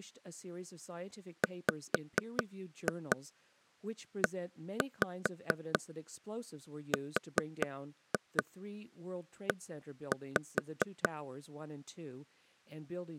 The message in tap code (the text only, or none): WERE